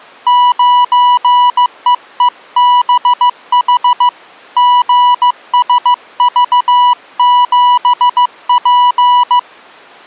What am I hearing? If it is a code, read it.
Morse code, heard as a keyed tone, hand-sent with a paddle, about 15 wpm, 980 Hz. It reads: 9EEBH GSV7P